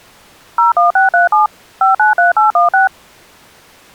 DTMF, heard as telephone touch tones, dialled by machine, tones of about 140 ms. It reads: 01637 593816